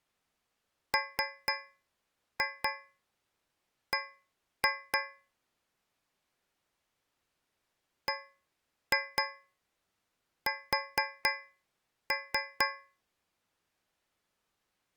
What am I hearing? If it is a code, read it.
Tap code, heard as taps on a metal pipe, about 4 knocks a second. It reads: MB BS